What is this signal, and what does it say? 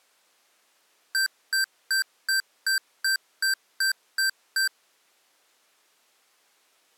Beep code, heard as beeps from a small speaker, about 1550 Hz. 10 short. In AMI BIOS tables: CMOS shutdown register error.